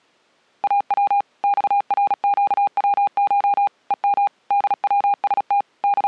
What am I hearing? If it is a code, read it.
Morse code (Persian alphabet), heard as a keyed tone, machine-sent, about 36 wpm, 810 Hz. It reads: او خرگوش هم دوست …